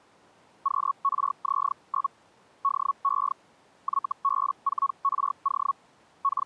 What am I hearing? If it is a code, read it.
Hellschreiber (Feld-Hell, 122.5 baud), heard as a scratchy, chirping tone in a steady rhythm, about 1110 Hz. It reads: QRZ? DE YB4RO …